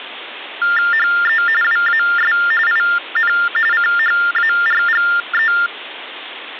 TTY/TDD text telephone tones (45.45 baud Baudot), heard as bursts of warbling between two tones, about 400 Hz shift, 1600 Hz centre, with phone line noise. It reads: HE WAS IN CHARGE